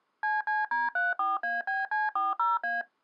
DTMF, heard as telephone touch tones, dialled by machine, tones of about 180 ms. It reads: CCD34ABC40A